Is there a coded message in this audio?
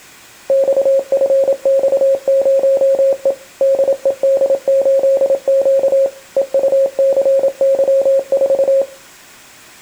Yes: Morse code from 0.4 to 8.9 s, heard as a keyed tone, machine-sent, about 27 wpm, 540 Hz. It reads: XFX0E DED8Q EUCY4